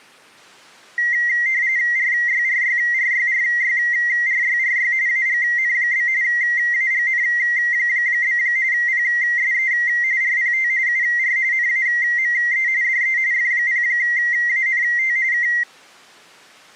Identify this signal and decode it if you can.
RTTY (45.45 baud, 170 Hz shift), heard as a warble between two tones, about 2000 Hz centre. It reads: RYRYRYRYRYRY AGN? AGN? PSE RPT UR NAME DE F0ANT K